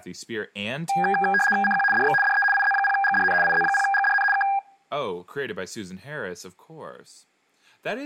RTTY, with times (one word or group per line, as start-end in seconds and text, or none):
1.6-1.8 CQ
1.9-2.1 DX
2.2-2.4 DE
2.5-3.3 IZ0GDN
3.4-4.2 IZ0GDN
4.3-4.4 K